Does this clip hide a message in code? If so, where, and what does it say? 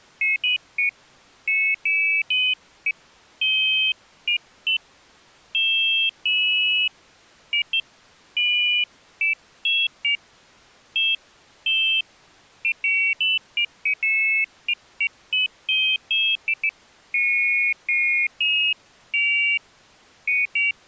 No, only pairs of high tones at irregular times.